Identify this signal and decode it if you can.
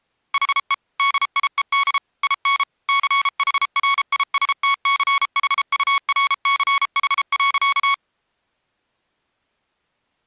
Morse code, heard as electronic beeps, machine-sent, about 33 wpm, 1110 Hz. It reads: HE DIED IN CHRISTCHURCH.